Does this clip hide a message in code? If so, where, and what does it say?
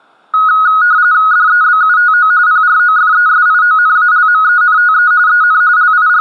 Yes: RTTY (45.45 baud, 170 Hz shift) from 0.3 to 6.2 s, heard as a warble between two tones, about 1360 Hz centre. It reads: DEBUTO PROFESIONALMENTE EN …